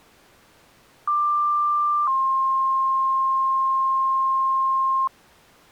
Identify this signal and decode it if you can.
Two-tone page, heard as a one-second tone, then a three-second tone, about 1180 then 1060 Hz.